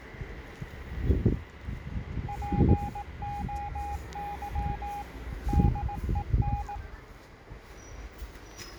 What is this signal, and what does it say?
Morse code (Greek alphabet), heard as a keyed tone, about 18 wpm, 820 Hz, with the noise of a residential street. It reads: ΠΟΥ ΔΕΝ